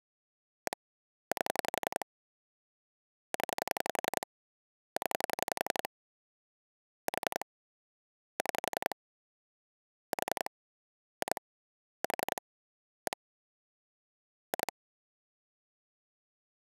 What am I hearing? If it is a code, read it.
Pulse dialling, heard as clicks on a phone line, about 11 pulses a second. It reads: 1 8 0 0 4 6 4 2 4 1 2